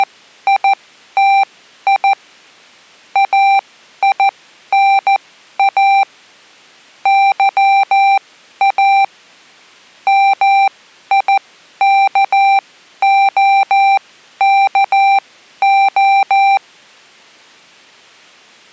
Morse code, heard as electronic beeps, machine-sent, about 14 wpm, spaced as for 11 wpm, 790 Hz. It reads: … AINA YA MIKOKO